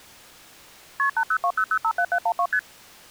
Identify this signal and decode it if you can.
Multi-frequency trunk signalling (R1, as on North American trunks), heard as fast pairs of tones, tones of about 70 ms. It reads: KP 8020057712 ST